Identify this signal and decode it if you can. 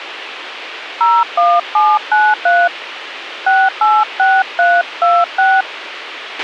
DTMF, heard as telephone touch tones, dialled by hand, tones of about 230 ms, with radio hiss and a squelch burst at the end. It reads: 01793 686326